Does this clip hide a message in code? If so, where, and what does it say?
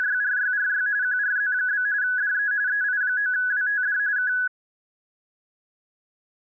Yes: RTTY (45.45 baud, 170 Hz shift) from 0.0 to 4.5 s, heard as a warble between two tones, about 1600 Hz centre. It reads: … QRZ? DE EI9WTD K